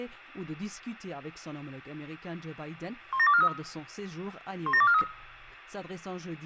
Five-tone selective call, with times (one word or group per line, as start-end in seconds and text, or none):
3.1-3.5 17243
4.7-5.0 17243